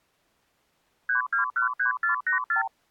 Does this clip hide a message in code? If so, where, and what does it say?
Yes: multi-frequency trunk signalling (R2, with the far end's replies) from 1.1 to 2.7 s, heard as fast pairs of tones, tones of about 120 ms. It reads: 3213484